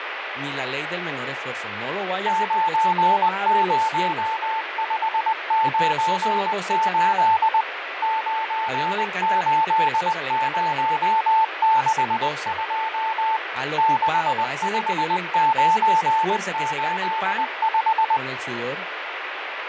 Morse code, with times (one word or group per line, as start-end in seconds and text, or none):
2.3-7.6 90598
8.0-13.4 98062
13.8-18.2 65985